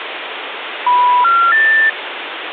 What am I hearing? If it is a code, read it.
Telephone call progress tone (North American plan), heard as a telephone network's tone, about 980, 1370, 1800 Hz, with phone line noise. Special information tone.